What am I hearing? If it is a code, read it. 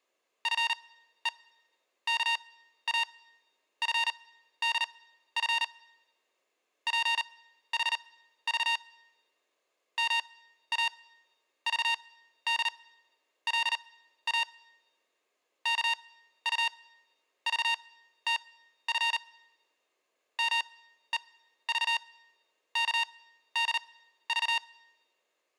Morse code (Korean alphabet), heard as electronic beeps, machine-sent, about 39 wpm, spaced as for 14 wpm, 930 Hz, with room echo. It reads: 나오는 줄 모르고 이런 말을